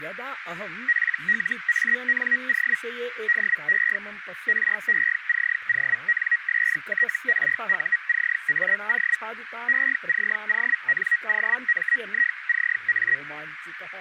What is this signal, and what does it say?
Hellschreiber (Feld-Hell, 122.5 baud), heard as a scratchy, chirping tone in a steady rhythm, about 1900 Hz, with radio static, a narrow filter and speech in Sanskrit. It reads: PLANO DE RECONSTRUCAO ECONOMICA